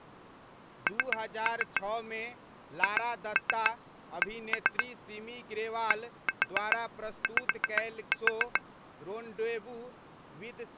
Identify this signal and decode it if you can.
Tap code, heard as taps on glass, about 7 knocks a second, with speech in Maithili. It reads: N HC DY